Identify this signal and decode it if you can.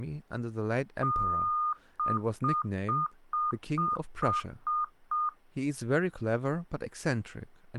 Beep code, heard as beeps, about 1220 Hz, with speech in English. 1 long, 8 short. In AMI BIOS tables: display or retrace test failure.